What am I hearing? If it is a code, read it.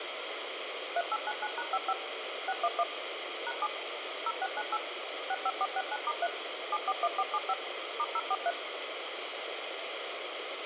DTMF, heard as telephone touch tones, dialled by machine, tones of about 50 ms, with radio hiss. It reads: 3899#55 611 #7 0698 65469*3 741475 *043